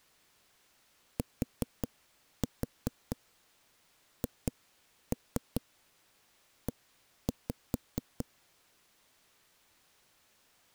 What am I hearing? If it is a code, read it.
Tap code, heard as knocks on a wall, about 5 knocks a second. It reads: THE